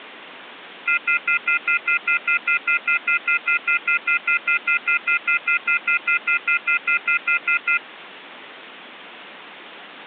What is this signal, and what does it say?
Telephone call progress tone (North American plan), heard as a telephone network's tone, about 1400, 2050, 2450, 2600 Hz, 0.1 s on and 0.1 s off. Off-hook warning tone.